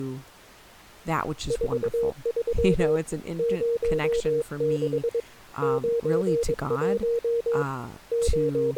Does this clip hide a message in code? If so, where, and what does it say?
Yes: Morse code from 1.4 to 8.8 s, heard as a keyed tone, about 22 wpm, 470 Hz, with speech in English. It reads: 43 06 91 …